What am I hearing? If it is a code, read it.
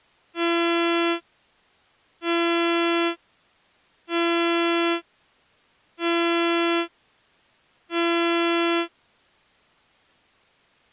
Ship horn signal, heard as a ship's horn, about 340 Hz. 5 short. At sea: I doubt that you are doing enough to avoid a collision.